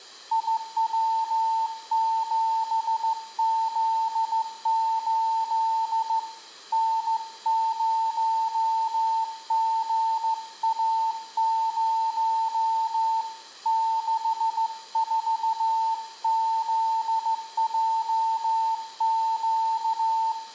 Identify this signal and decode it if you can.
Morse code, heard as a keyed tone, hand-sent with a straight key, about 15 wpm, 900 Hz, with room echo. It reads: IW7Z8 N0GA0 64ZJQ